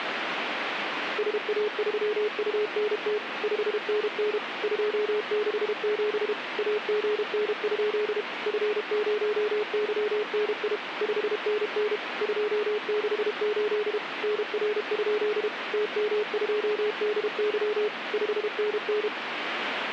Morse code, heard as a keyed tone, machine-sent, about 32 wpm, 420 Hz, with radio static. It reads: SA3UNT 5NN 267 AGN? F0YNI 5NN 268 NR? TM2DY 5NN